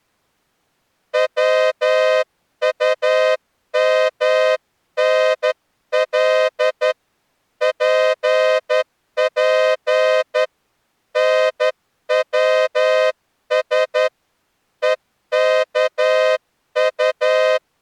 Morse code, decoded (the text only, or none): WUMNL PP NWS EKU